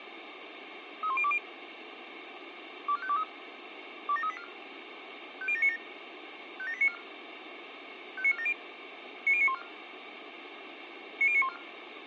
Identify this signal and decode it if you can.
Five-tone selective call (ZVEI), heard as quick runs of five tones, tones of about 70 ms, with radio hiss. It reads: 31020 24523 27384 50797 57894 59470 90914 90914